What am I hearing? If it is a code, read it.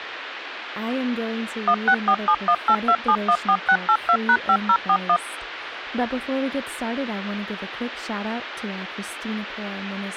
DTMF, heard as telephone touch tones, dialled by machine, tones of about 70 ms, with radio hiss and speech in English. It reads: 1647182714682#5041